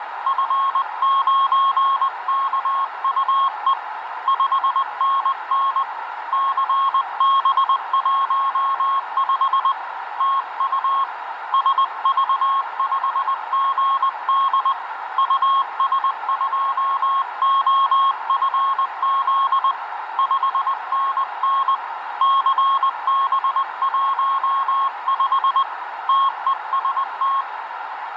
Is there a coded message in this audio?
Yes: Morse code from 0.2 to 27.5 s, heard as a keyed tone, hand-sent with a paddle, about 20 wpm, 1090 Hz, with radio static and a narrow filter. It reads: F9KUE 5NN CB15 TU SV5GD US2OFZ 5NN CB15 TEST